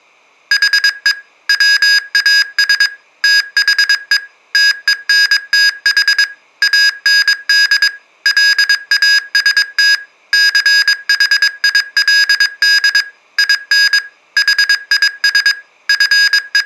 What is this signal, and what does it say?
Morse code, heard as electronic beeps, machine-sent, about 22 wpm, 1650 Hz, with room echo. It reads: HE WAS THE TENTH AND LAST CHILD IN HIS …